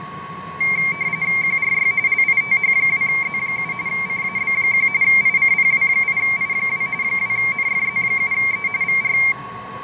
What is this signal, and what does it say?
RTTY (45.45 baud, 170 Hz shift), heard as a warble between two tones, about 2200 Hz centre, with fading, a steady whistle near 1110 Hz and street noise. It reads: QRY LITH2Z7 CAB1 ICPW8I2 2NFZ7E VR